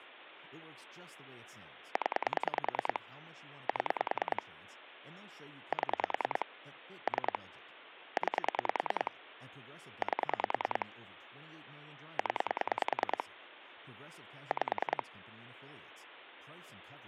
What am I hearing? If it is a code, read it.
Pulse dialling, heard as clicks on a phone line, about 10 pulses a second, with phone line noise and speech in English. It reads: 0 7 7 3 9 8 0 5